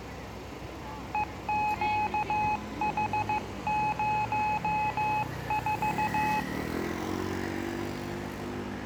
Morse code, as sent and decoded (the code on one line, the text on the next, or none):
. --.- .... ----- ....-
EQH04